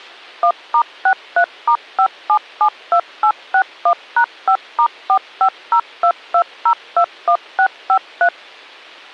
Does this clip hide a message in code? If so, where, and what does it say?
Yes: DTMF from 0.4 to 8.3 s, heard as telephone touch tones, dialled by machine, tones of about 80 ms, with a squelch burst at the end. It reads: 1*63*5772861#5*45022021653